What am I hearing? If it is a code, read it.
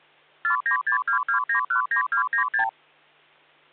Multi-frequency trunk signalling (R2, with the far end's replies), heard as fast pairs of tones, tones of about 100 ms, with hum. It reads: 49622919296